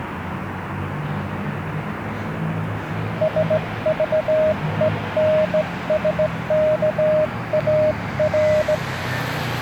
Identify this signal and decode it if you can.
Morse code, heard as a keyed tone, hand-sent with a straight key, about 17 wpm, 620 Hz, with street noise. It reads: SVENSKAR